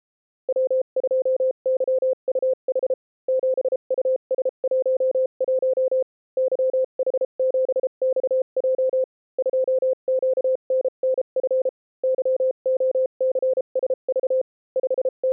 Morse code, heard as a keyed tone, machine-sent, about 33 wpm, spaced as for 29 wpm, 520 Hz. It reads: W2YUH 7US11 YH7XJ 2QNNF YOCSV …